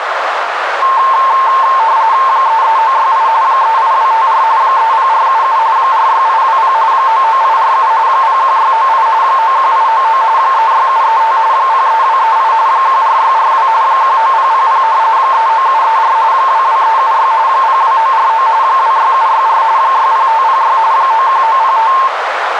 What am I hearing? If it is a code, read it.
RTTY (45.45 baud, 170 Hz shift), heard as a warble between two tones, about 980 Hz centre, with radio static and a narrow filter. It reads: 33968 38254 30477 46820 99847 01698 91899 36735 03238 14642 19000 39734 22376 02949 26764 60506 91905